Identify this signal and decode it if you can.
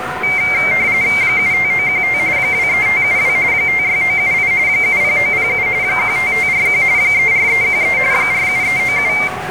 RTTY (45.45 baud, 170 Hz shift), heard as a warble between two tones, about 2200 Hz centre, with radio static, a steady whistle near 740 Hz and the noise of a residential street. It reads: 75915 23572 56978 70907 15541 34313 47397